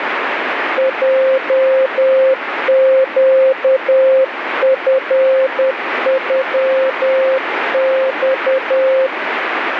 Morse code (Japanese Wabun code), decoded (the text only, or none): ヲネチノマ